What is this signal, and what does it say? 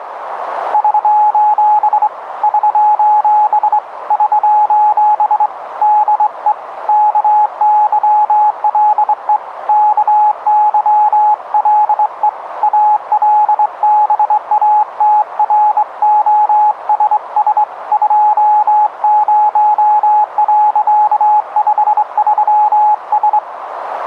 Morse code, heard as a keyed tone, hand-sent with a straight key, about 23 wpm, 840 Hz, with radio static and a narrow filter. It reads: <SOS> <SOS> <SOS> DE KYLE KYLE ALBATROSS 20.53S